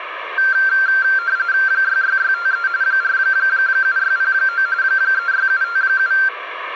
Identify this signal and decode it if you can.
RTTY (45.45 baud, 170 Hz shift), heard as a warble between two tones, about 1470 Hz centre, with radio static and room echo. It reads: 66653 47609 36757